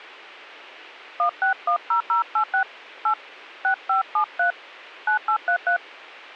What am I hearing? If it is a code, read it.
DTMF, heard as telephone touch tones, dialled by hand, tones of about 100 ms. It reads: 1610086 8 6573 9833